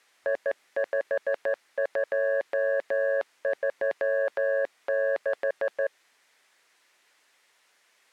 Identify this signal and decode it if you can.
Morse code, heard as a keyed tone, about 14 wpm, 550 Hz. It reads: I5236